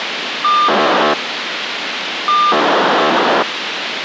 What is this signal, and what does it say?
POCSAG pager data (2400 baud), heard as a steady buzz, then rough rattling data, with radio hiss.